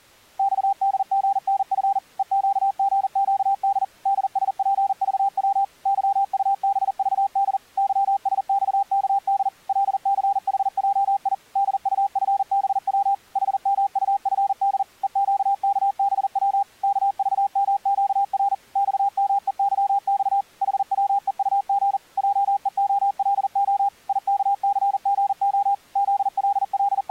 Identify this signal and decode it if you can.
Morse code, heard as a keyed tone, machine-sent, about 40 wpm, 800 Hz. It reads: XDGNF EQGQD DSPVW YUBVD YSXKD LCHJI DUFBW HMUFD EQKBW KVMQR XMEYX HWEUG JEOLO IKCGO …